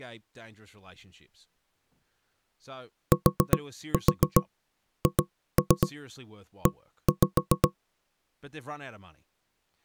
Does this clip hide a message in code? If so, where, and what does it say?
Yes: tap code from 3.1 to 7.8 s, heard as knocks on wood, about 7 knocks a second, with speech in English. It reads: THE